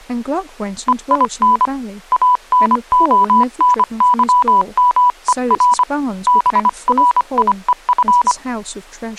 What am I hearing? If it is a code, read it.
Morse code, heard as a keyed tone, hand-sent with a paddle, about 25 wpm, 980 Hz, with speech in English. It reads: EIN ANONYMER BRIEF